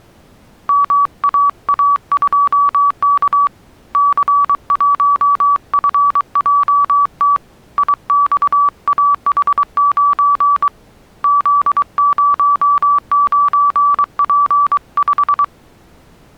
Morse code, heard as a keyed tone, hand-sent with a bug key, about 23 wpm, 1150 Hz. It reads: MAA2K C1FJT IXAH9 Z09P5